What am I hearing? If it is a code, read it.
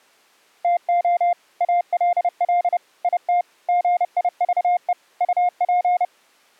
Morse code, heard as a keyed tone, machine-sent, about 30 wpm, 710 Hz. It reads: TO ALL IT GIVE UP